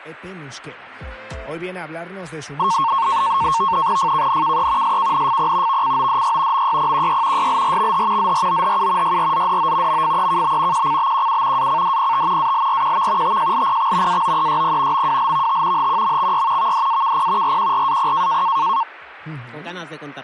NAVTEX (SITOR-B), 100 baud, 170 Hz shift, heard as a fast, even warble, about 1000 Hz centre. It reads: FKNKE SKNFP VCODY MYPQY YLRXH ZROHU YRZDO MFEKB QCBQU ACDPT ALRQV TJLPX AOEYP MWLVT HQMXY VDAKP RQRAP